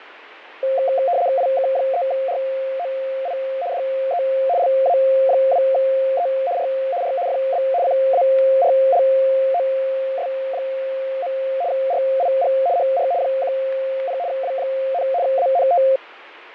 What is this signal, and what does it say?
RTTY (75 baud, 170 Hz shift), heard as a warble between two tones, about 620 Hz centre, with fading. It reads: IK3ROI DE LA2E R R FB CARLOS. RIG HR 10 W, ANT